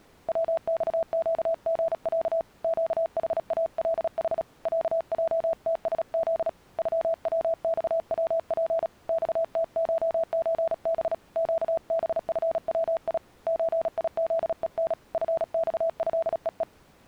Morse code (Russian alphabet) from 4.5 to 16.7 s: ЯЙТСЗ ЮВЬВП ЬТШЧБ ЩБФВИ ЧИЗЕН ФЬЭЕЕ

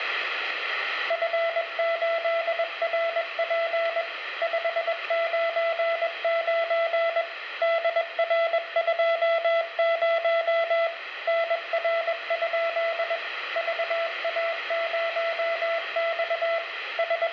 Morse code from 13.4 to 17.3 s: VA0X …

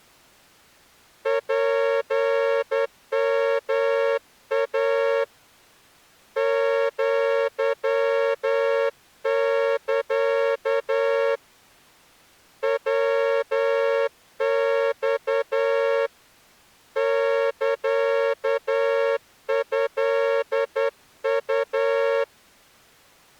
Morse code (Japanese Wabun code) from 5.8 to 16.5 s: アサ ヤマ

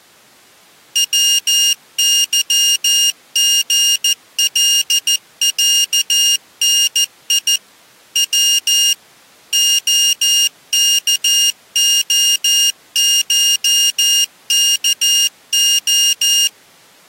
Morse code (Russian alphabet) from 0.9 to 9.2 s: ВЫГЛЯНИ В

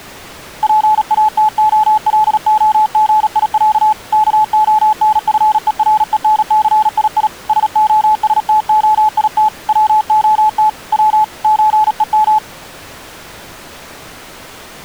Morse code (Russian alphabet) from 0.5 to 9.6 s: ПАТОЛОГИЯ КОНФЕРЕНЦИИ СОСТОИТ

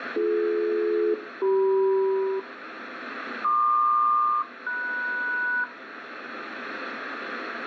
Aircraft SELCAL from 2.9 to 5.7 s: PQ-MS

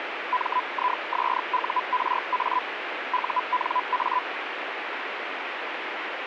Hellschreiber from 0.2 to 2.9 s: MISURA

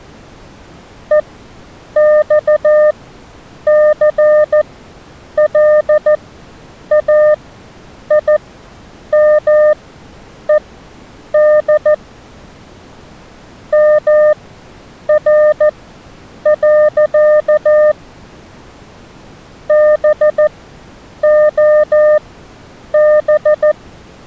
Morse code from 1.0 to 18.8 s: EXCLAIMED MR.

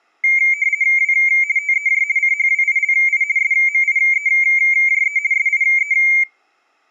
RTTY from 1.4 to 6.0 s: TEJ CHWILI SMIEJE SIE

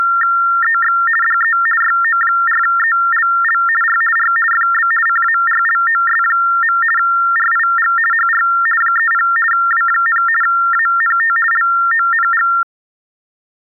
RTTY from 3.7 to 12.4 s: R R FB CARLOS. RIG HR 30 W, ANT LONG

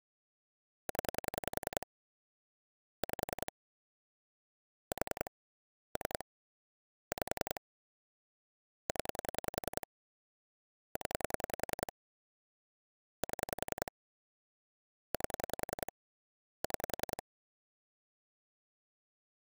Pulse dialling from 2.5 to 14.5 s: 5 4 3 5 0 0 7

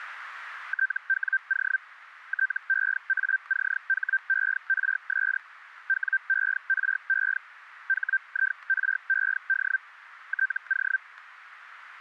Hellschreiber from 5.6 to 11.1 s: WERE HIRED TO

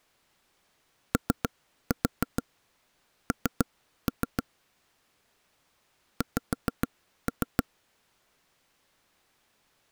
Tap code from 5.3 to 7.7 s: X

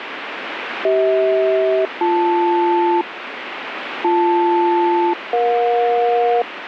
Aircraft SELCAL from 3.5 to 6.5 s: BL-EJ

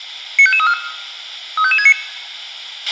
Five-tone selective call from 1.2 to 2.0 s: 35569

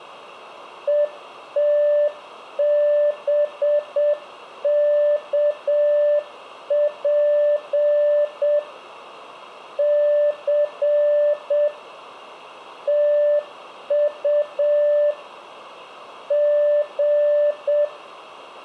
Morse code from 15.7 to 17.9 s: G

